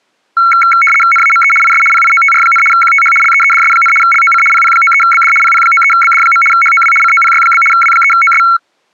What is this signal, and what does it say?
RTTY (75 baud, 850 Hz shift), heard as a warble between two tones, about 1800 Hz centre. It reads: NAME IS PIOTR, QTH LEEDS, LOC PP93BD PP93BD. HOW COPY? W3OS